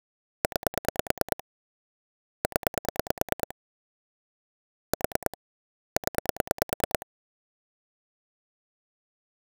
Pulse dialling, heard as clicks on a phone line, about 9 pulses a second. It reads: 9 0 4 0